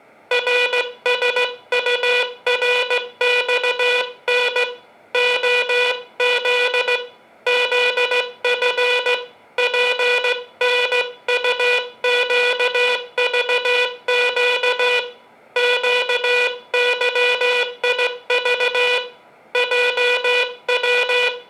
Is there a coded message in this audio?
Yes: Morse code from 0.3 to 21.5 s, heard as a buzzer, hand-sent with a straight key, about 16 wpm, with room echo. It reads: RSURXN OZ ZF PNUQVQ QYIV …